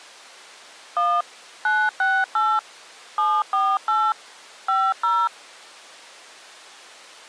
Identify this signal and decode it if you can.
DTMF, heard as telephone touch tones, dialled by machine, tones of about 240 ms. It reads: 1 968 748 50